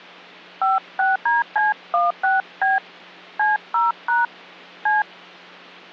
DTMF, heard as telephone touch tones, dialled by hand, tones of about 170 ms, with hum. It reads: 56DC16B C0# C